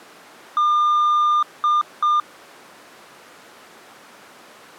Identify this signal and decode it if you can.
Beep code, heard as beeps, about 1200 Hz. 1 long, 2 short. In Award, IBM and AMI BIOS tables: video adapter failure.